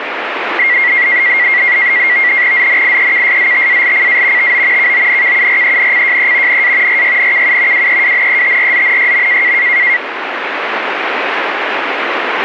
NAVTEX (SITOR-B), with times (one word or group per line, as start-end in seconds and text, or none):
2.5-4.5 ZNIEKSZTALCA
4.4-4.9 TO
4.8-6.6 KONKURENCJE
6.5-7.0 NA
6.9-7.9 RYNKU
7.7-9.5 WEWNETRZNYM